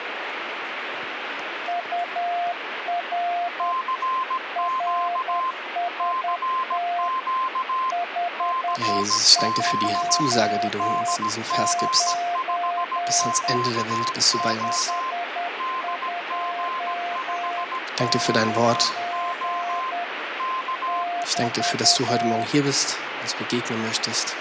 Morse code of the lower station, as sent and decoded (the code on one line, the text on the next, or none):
..- .-. / .-. ... - / ..... ..--- ----. / ..... ..--- ----. / -...-
UR RST 529 529 <BT>